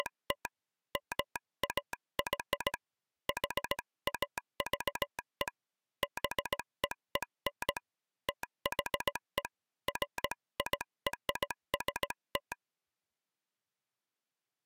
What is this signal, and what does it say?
Morse code (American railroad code), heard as a telegraph sounder, hand-sent with a straight key. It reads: … MAY HAVE BEEN THE FIRST